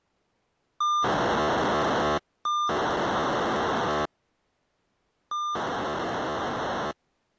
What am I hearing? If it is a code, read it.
POCSAG pager data (2400 baud), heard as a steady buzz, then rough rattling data.